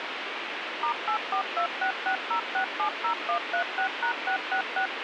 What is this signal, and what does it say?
DTMF, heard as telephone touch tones, dialled by machine, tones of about 90 ms, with radio hiss. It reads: *842660670136#666